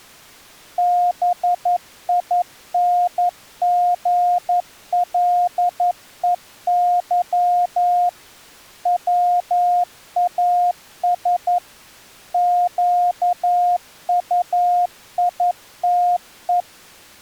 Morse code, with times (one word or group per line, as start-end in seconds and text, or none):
0.8-8.1 BINGLEY
8.9-11.6 WAS
12.3-16.6 QUITE